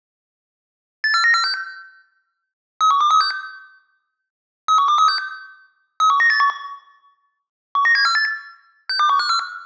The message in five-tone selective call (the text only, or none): 84946 31236 31236 31981 19748 62154